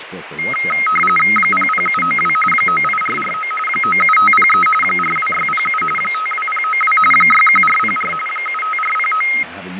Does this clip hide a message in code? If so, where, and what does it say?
Yes: RTTY (45.45 baud, 850 Hz shift) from 0.4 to 9.4 s, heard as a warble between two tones, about 1700 Hz centre, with radio static, fading and speech in English. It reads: 00792 98449 97503 42607 52092 61404 75409